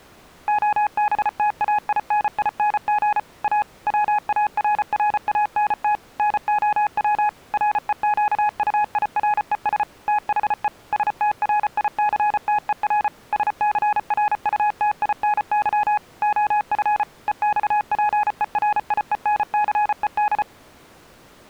Morse code, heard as a keyed tone, machine-sent, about 34 wpm, 840 Hz. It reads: OBTAINING A WARRANT NOW REQUIRES THE STRICTER SCRUTINY OF EXPERIENCED